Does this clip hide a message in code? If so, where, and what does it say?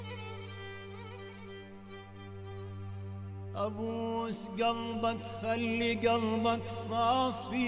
No.